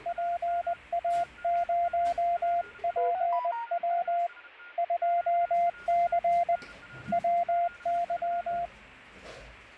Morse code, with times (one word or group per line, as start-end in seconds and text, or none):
0.1-4.3 PA0PW
4.8-6.6 2C
7.1-8.7 WY